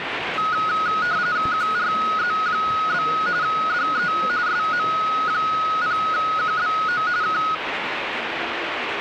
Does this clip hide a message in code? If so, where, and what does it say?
Yes: RTTY (45.45 baud, 170 Hz shift) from 0.4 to 7.5 s, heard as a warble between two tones, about 1360 Hz centre, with radio static and the noise of a subway station. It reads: QRZ? DE SM0QBO K